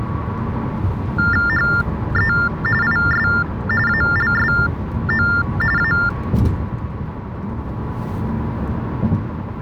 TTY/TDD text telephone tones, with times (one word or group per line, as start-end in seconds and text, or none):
1.5-2.3 HE
2.8-3.3 IS
3.9-5.3 ALSO
5.8-5.9 A